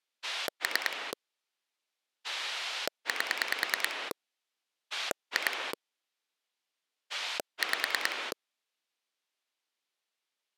Pulse dialling, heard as a rotary dial, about 9 pulses a second. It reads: 3 8 2 5